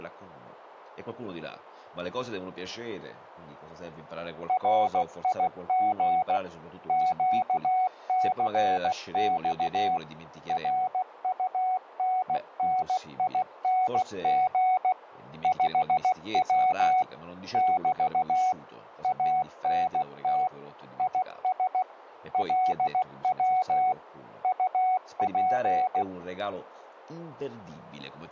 Morse code, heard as a keyed tone, machine-sent, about 16 wpm, 740 Hz. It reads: RIG QCX RUNNING 5W <BT> ANT IS LW UP